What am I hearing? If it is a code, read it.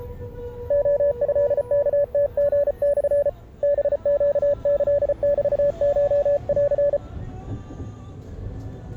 Morse code (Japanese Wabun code), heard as a keyed tone, hand-sent with a paddle, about 34 wpm, 570 Hz, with the noise inside a bus. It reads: レトワムリモ ハネキメコン